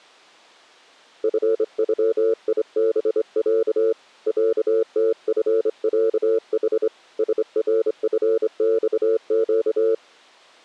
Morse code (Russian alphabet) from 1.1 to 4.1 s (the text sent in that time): ФЮИБЯ